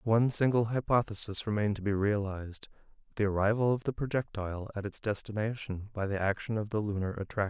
Speech in English. There is no code.